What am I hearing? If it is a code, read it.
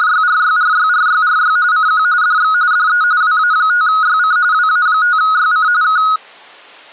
RTTY (45.45 baud, 170 Hz shift), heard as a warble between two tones, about 1360 Hz centre. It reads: … CQ DX DE WA5YC WA5YC K